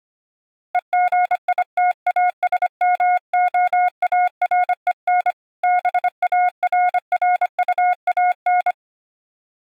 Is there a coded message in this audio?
Yes: Morse code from 0.7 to 8.8 s, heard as a keyed tone, hand-sent with a bug key, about 25 wpm, 720 Hz. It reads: EGITASMOAREN BARRUAN